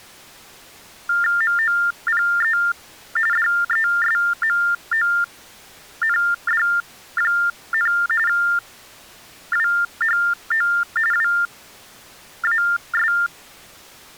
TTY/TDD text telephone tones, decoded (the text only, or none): MOPE DESMOND, WHO WAS